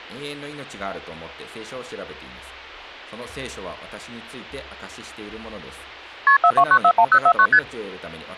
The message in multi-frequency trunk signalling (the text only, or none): KP 42941049 ST